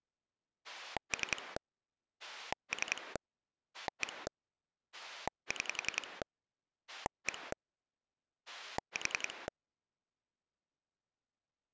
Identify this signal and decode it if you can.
Pulse dialling, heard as a rotary dial, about 10 pulses a second. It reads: 3 3 1 6 1 4